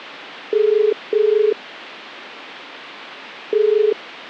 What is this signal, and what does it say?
Telephone call progress tone (as in the UK, Ireland, Australia and similar networks), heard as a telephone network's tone, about 430 Hz. Ringback tone.